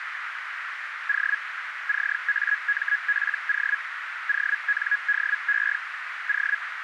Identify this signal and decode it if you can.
Hellschreiber (Feld-Hell, 122.5 baud), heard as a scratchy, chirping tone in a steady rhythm, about 1650 Hz, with radio static and a narrow filter. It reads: O CAMPO ONDE O